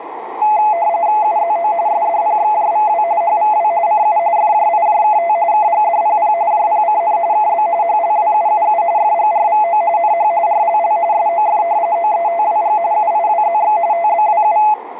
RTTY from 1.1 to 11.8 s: UZO SDPXJVW HVW CU FJIJKT KGDPP JPCN KB HLWUUU FGRVO NH RLL SOF

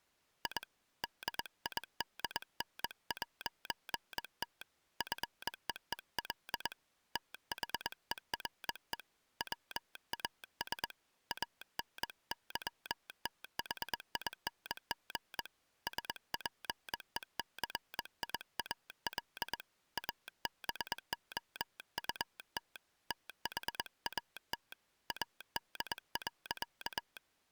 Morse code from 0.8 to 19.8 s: DIDN'T FEEL THERE WAS ANYTHING SPECIAL

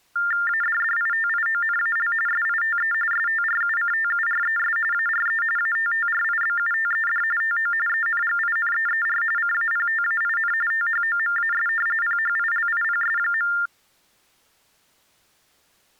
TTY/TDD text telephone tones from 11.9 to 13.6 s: PHILIPS.

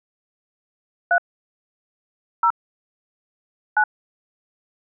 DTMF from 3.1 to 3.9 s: 9

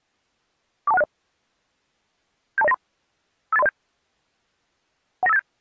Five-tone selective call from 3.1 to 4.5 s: 58307

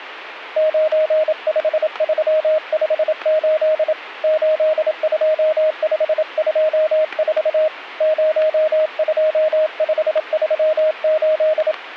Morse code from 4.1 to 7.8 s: 82524

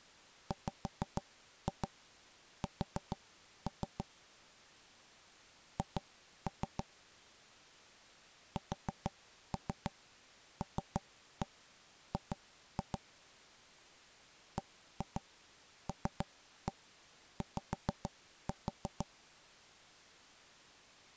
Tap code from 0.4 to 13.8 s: WS H SLG

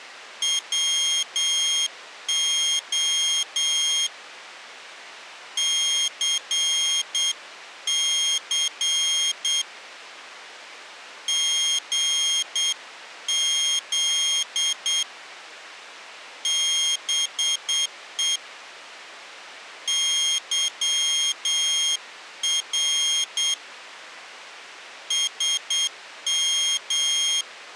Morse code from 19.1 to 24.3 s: YR

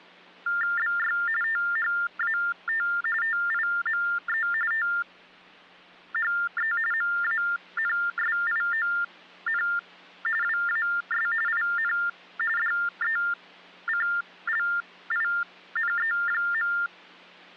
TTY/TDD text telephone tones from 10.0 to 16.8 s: WAS IN DECLINE.

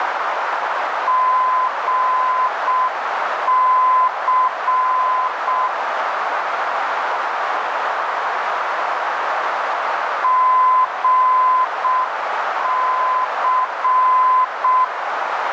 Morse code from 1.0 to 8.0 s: GC

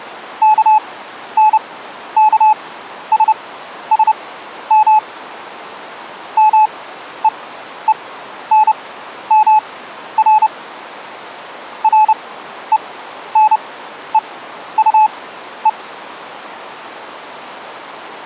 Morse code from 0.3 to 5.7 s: KNKSSM

